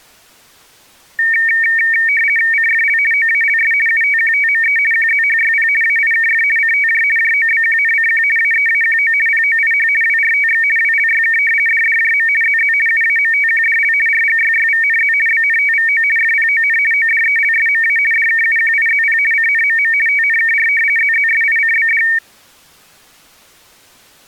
RTTY (50 baud, 450 Hz shift), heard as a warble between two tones, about 2050 Hz centre. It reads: CFL OALS UTQTME QZHYP AIKF CTJ JOBQNCQ AEAQO POIH WRTX WLYK DDJM ZZ UAMTQDL RGYYVNZ BNTVO FPON ODELSMA DKUQIZP CNMM TNKR ZZSICBD